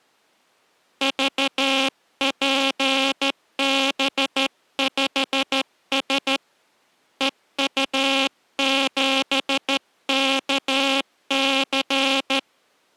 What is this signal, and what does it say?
Morse code, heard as a buzzer, hand-sent with a straight key, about 13 wpm. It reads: VPB5S EU7KC